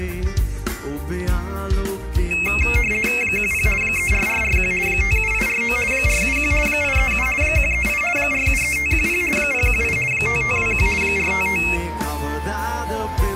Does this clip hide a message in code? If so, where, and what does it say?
Yes: RTTY (50 baud, 450 Hz shift) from 2.3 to 11.8 s, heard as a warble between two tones, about 2350 Hz centre. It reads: 10 34441 57849 471 837 138 473510 018 5521 455